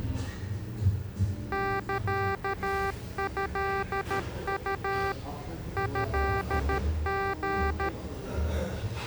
Morse code (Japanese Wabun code), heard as electronic beeps, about 13 wpm, 390 Hz, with the noise of a cafe. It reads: サトウ トリ